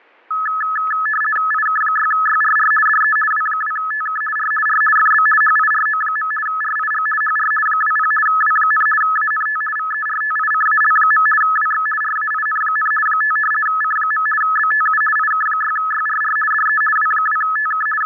RTTY (50 baud, 450 Hz shift), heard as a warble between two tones, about 1500 Hz centre, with fading and static crashes. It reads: IK6YRR DE W2TK R R FB HIRO. RIG HR 20 W, ANT VERTICAL. WX RAIN, 5 C. BTU IK6YRR DE W2TK …